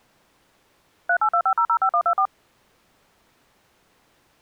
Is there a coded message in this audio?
Yes: DTMF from 1.1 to 2.3 s, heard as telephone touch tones, dialled by machine, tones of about 80 ms. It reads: 3825005124